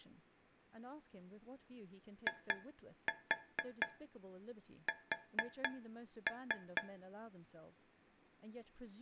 Tap code, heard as taps on a metal pipe, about 4 knocks a second, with speech in English. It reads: IS